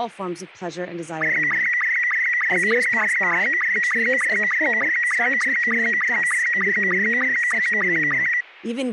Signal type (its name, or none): SSTV (slow-scan television)